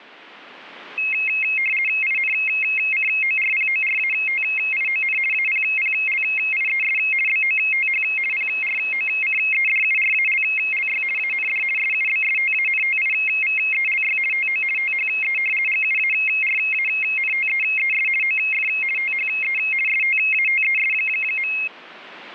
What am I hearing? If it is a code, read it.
RTTY (50 baud, 450 Hz shift), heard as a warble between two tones, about 2350 Hz centre. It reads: INCORPORATION APPLIES BOTH PROCEDURALLY AND SUBSTANTIVELY TO THE GUARANTEES OF THE STATES.